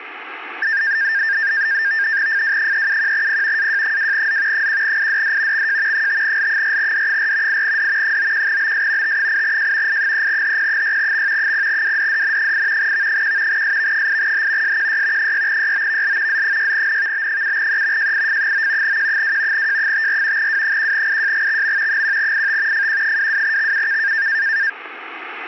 NAVTEX (SITOR-B), 100 baud, 170 Hz shift, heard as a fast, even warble, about 1700 Hz centre, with radio static. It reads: FW371P AJ2Z 1IDD XJ 5L4D4 8D 91BS T8J I3HP6X 0WDDN8 V1 SV8H SQY 6YOVL Z6NVB7E JIF9 Q2 J54 W1IJGXM 1IT FQ22XUK